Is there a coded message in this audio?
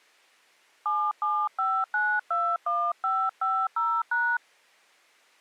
Yes: DTMF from 0.9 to 4.4 s, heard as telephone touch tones, dialled by hand, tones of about 260 ms. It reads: 775921550#